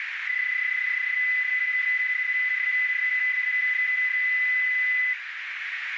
PSK31 (31.25 baud), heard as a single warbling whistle, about 2000 Hz, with radio static and a narrow filter.